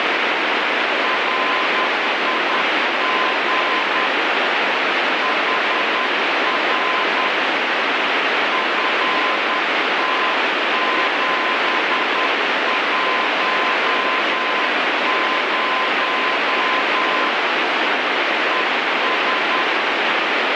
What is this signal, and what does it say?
Morse code, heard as a keyed tone, hand-sent with a paddle, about 10 wpm, 1030 Hz, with heavy radio static. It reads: RIG HR FT710 ES